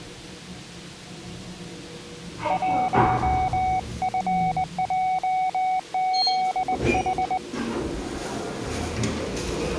Morse code, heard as a keyed tone, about 20 wpm, 750 Hz, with the noise inside a lift. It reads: 1FJZH